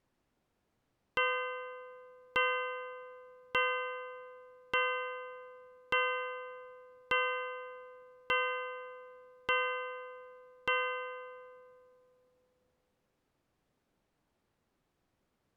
Clock strike, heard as a bell. 9. Nine o'clock.